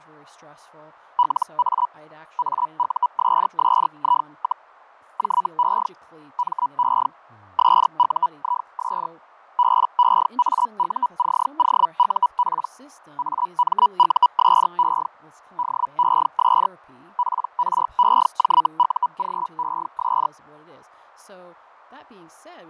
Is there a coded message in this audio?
Yes: Hellschreiber (Feld-Hell, 122.5 baud) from 1.2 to 20.3 s, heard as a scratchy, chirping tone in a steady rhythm, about 980 Hz, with fading and speech in English. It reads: LA AUSSI, JE ME SUIS BEAUCOUP AMUSE DES PREJUGES